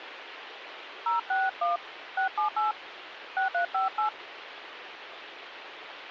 DTMF, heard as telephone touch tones, dialled by hand, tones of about 160 ms, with radio hiss. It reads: 061 678 6358